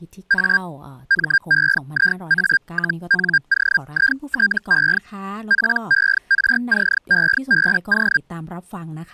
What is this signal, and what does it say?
Hellschreiber (Feld-Hell, 122.5 baud), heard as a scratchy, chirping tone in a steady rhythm, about 1600 Hz, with speech in Thai. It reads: A MEIA-NOITE PERCEBO